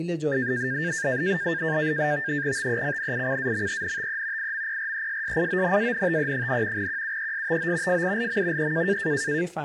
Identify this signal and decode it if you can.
NAVTEX (SITOR-B), 100 baud, 170 Hz shift, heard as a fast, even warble, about 1700 Hz centre, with speech in Persian. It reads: TECNICAMENTE IMPRESSIONANTE, QUESTO FILM E